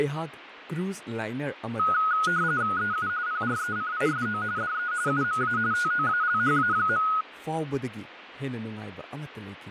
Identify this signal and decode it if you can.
RTTY (45.45 baud, 170 Hz shift), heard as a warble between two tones, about 1360 Hz centre, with radio static and speech in Manipuri. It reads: EU PRECISO DE UMA TOALHA.